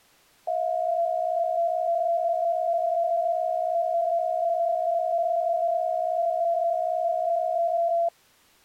PSK63 (62.5 baud), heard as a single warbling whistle, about 680 Hz.